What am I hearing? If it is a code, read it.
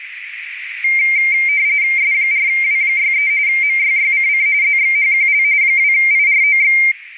RTTY (45.45 baud, 170 Hz shift), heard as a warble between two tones, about 2200 Hz centre, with radio static and a narrow filter. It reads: S4W63 MYYCC ZXHQL 2IROX